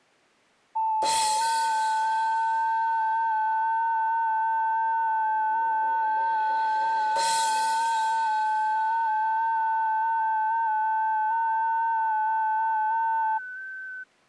FT8 (several signals at once), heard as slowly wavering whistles, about 6.25 baud.